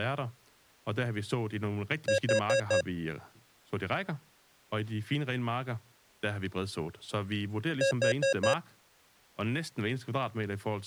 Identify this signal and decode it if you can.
Alarm pattern, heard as an alarm's beeps, played twice, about 540 Hz, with speech in Danish. Temporal four. Carbon monoxide.